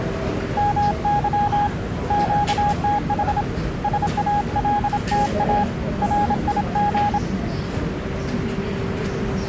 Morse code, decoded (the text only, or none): MY QTH SALTA RIG